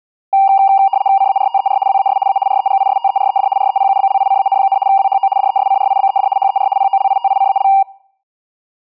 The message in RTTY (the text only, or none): CARTER WAS A REGISTERED REPUBLICAN, WHO DESCRIBED HER POLITICAL